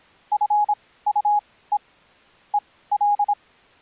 Morse code, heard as a keyed tone, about 26 wpm, spaced as for 17 wpm, 830 Hz. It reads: FUE EL